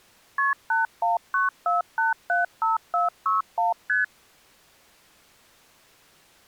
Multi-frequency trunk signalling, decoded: KP 8194875461 ST

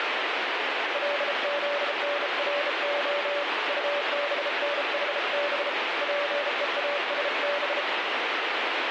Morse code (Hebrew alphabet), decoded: לזנרה טבנחב פואשב

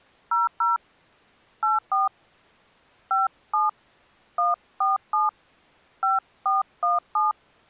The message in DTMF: 00 84 57 147 5417

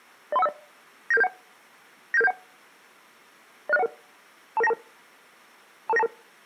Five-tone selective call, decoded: 03150 97771 97771 06011 22922 22922

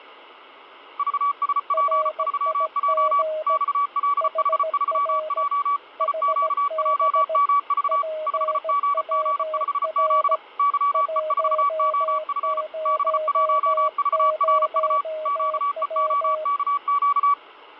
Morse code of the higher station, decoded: VSP3J XLH3J IQJMV 5GG5Z YE4OF B1VRU QEOKQ

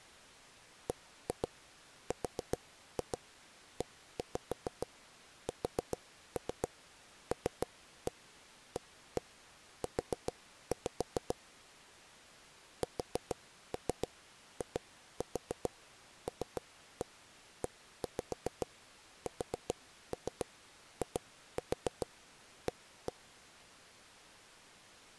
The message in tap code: BRESLAU SILESIA

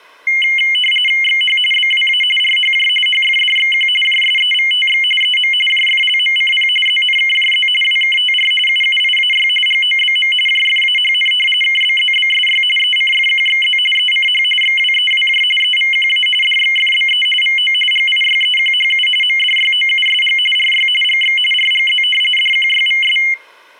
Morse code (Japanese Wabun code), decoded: none

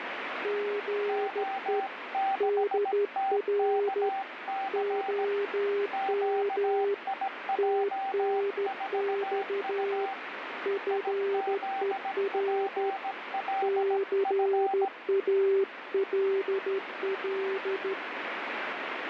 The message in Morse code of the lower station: GE DR OM TNX FER CALL

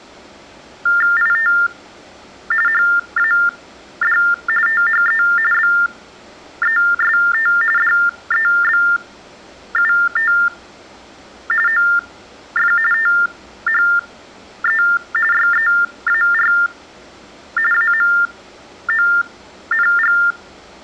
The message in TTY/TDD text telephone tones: IT HAD THE BEST DEBUT OF THE YEAR AMONG

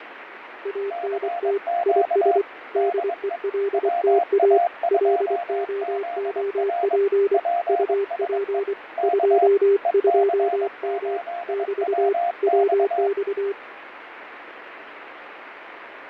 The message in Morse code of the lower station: ANT IS DELTA LOOP UP 22M <BT> WX

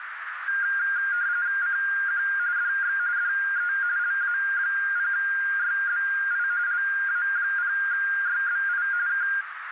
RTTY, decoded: CQ DX DE LA0YBI LA0YBI K

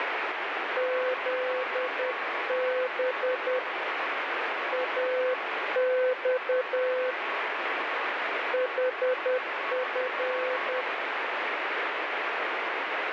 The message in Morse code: ZB AX HF

